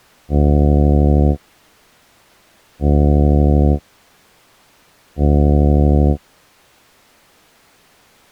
Ship horn signal, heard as a ship's horn, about 70 Hz. 3 short. At sea: I am operating astern propulsion.